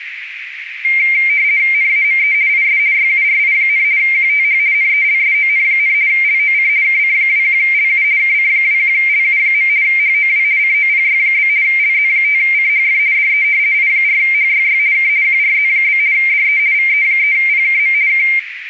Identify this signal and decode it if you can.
RTTY (50 baud, 170 Hz shift), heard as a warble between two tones, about 2200 Hz centre, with radio static and a narrow filter. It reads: NAME IS YURI, QTH NELSON, LOC KC21LU KC21LU. HOW COPY? LZ5CHF DE I4HYY K QRZ? DE VE3PKM K